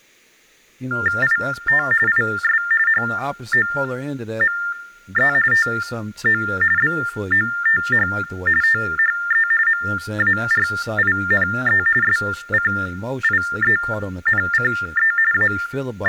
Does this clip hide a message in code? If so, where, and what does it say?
Yes: TTY/TDD text telephone tones (45.45 baud Baudot) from 0.9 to 16.1 s, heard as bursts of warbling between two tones, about 400 Hz shift, 1600 Hz centre, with speech in English. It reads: IT IS HOME TO BOTH THE MARINE SCIENCE …